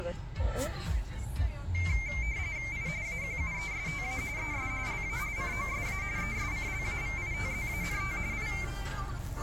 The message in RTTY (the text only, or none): I AQUESTA ES LA COSA ESCLAVITZANT I